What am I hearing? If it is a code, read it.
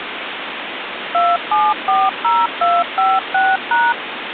DTMF, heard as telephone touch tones, dialled by machine, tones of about 220 ms, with phone line noise. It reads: 2740256#